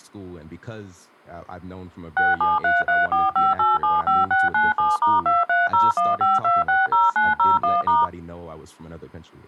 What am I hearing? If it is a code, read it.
DTMF, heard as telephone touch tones, dialled by machine, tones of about 180 ms, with speech in English. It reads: 673345875697*23015260901*